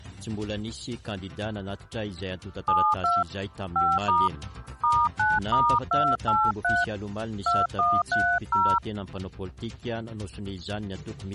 DTMF, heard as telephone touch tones, dialled by hand, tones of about 230 ms. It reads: 72 5* *9*283 2130